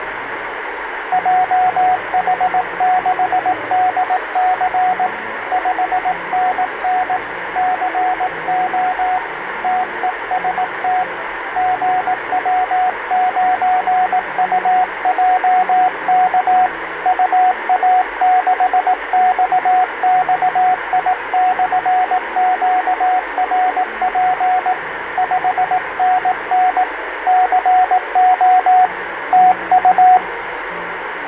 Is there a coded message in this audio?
Yes: Morse code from 1.1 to 30.2 s, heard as a keyed tone, hand-sent with a paddle, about 18 wpm, 740 Hz, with radio static and fading. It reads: JH6DC 5NN CO TEST GW9UJK UA6XXI/QRP 5NN CO TU